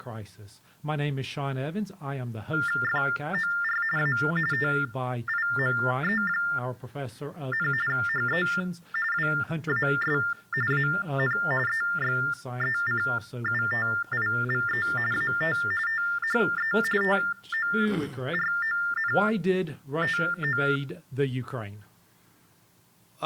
TTY/TDD text telephone tones (45.45 baud Baudot), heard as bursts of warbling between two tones, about 400 Hz shift, 1600 Hz centre. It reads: FOR A TIME, HE WAS AN EXECUTIVE AT THE TORONTO